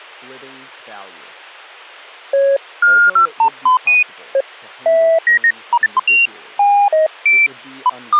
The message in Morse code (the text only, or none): none